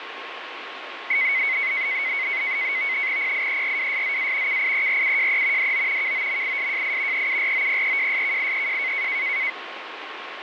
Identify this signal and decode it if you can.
NAVTEX (SITOR-B), 100 baud, 170 Hz shift, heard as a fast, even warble, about 2150 Hz centre, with radio static and a steady whistle near 1080 Hz. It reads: PIERWSZA KIERUJE DO KOMISJI EUROPEJSKIEJ